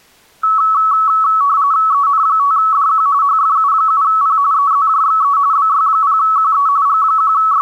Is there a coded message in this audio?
Yes: RTTY (45.45 baud, 170 Hz shift) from 0.4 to 7.6 s, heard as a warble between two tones, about 1210 Hz centre. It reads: EN5DQ HFU7P EZJXE BY0QE …